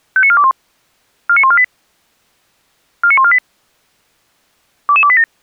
Five-tone selective call (ZVEI), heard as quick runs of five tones, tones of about 70 ms. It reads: 59421 49148 49148 22287